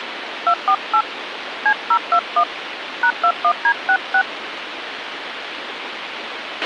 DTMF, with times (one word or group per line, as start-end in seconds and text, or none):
0.5-1.0 248
1.7-2.4 C021
3.0-4.2 #21D66